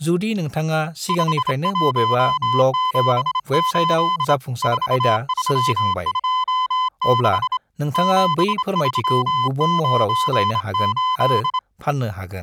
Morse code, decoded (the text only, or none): 5178 4326 7398